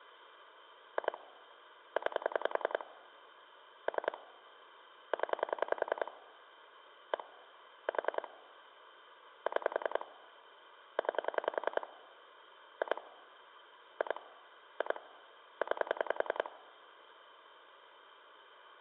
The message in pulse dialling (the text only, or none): 2 9 3 0 1 4 6 9 2 2 2 9